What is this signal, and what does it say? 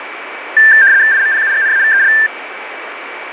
RTTY (75 baud, 170 Hz shift), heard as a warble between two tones, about 1700 Hz centre, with radio static and a steady whistle near 2300 Hz. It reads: IMPUGNAVEL